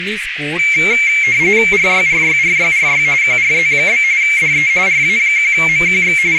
RTTY (45.45 baud, 170 Hz shift), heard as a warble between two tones, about 2250 Hz centre, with radio static, a narrow filter and speech in Dogri. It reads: RYRYRYRY QRZ? DE RA1MQX …